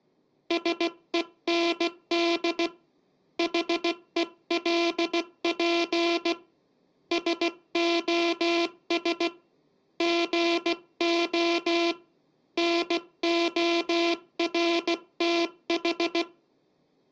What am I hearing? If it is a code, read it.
Morse code, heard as a buzzer, hand-sent with a paddle, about 16 wpm, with room echo. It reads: SEND HELP SOS GO NORTH